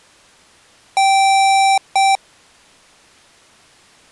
Beep code, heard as beeps from a small speaker, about 780 Hz. 1 long, 1 short. In IBM BIOS tables: system board problem.